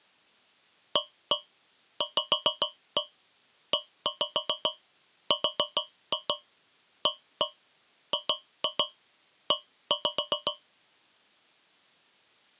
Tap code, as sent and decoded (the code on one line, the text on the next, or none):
1-1 5-1 1-5 4-2 1-1 2-2 1-5
AVERAGE